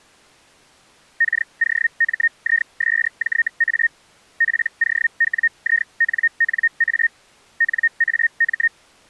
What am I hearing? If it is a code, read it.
Hellschreiber (Feld-Hell, 122.5 baud), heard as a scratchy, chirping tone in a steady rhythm, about 1850 Hz. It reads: KOMISJA POWINNA NAM